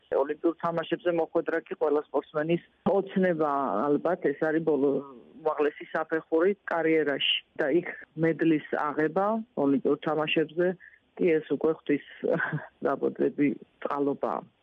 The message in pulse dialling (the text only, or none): none